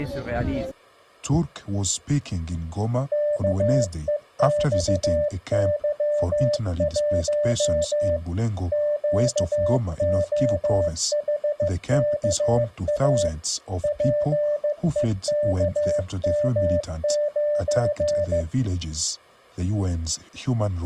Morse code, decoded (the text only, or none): KEXY1 QOHKA PEKM9